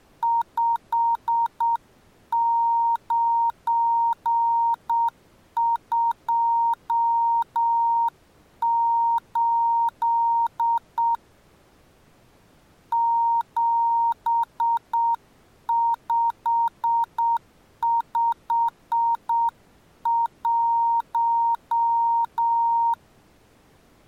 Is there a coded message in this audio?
Yes: Morse code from 0.2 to 23.0 s, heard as a keyed tone, hand-sent with a straight key, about 7 wpm, 930 Hz. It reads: 5928 7551